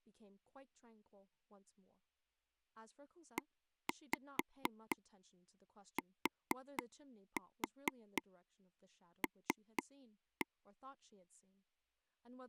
Tap code, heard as taps on a table, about 4 knocks a second, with speech in English. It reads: ETL